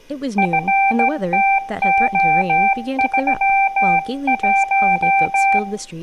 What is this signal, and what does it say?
Morse code, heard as a keyed tone, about 16 wpm, 780 Hz, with room echo and speech in English. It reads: FTO31